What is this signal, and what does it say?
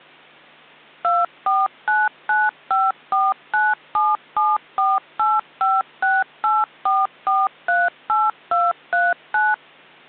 DTMF, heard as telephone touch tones, dialled by machine, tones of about 200 ms. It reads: 249954977485684438239